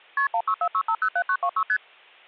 Multi-frequency trunk signalling (R1, as on North American trunks), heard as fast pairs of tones, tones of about 70 ms, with hum. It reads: KP 1646507926 ST